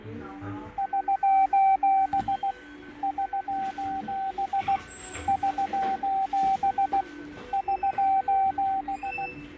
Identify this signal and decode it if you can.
Morse code, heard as a keyed tone, machine-sent, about 16 wpm, 770 Hz, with fading, a weaker station near 1520 Hz and the noise of a crowd indoors. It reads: <SOS> <SOS> <SOS> <SOS>